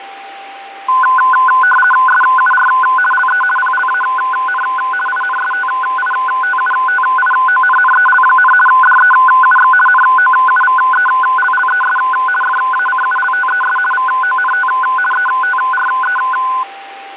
RTTY (50 baud, 450 Hz shift), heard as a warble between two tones, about 1260 Hz centre, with radio static, fading and a steady whistle near 790 Hz. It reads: SUR LE PLAN INSTITUTIONNEL, DEUX NOUVELLES FACULTES VONT ETRE